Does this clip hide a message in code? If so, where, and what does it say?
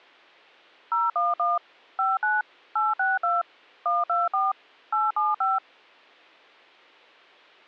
Yes: DTMF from 0.9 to 5.6 s, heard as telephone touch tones, dialled by machine, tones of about 180 ms. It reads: 011 59 862 124 875